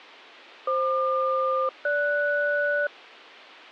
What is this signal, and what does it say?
Aircraft SELCAL, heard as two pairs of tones. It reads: FQ-GS